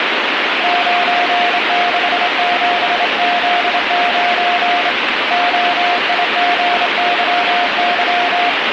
Morse code, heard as a keyed tone, hand-sent with a straight key, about 26 wpm, 710 Hz, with heavy radio static. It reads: 967Z9 OIGYY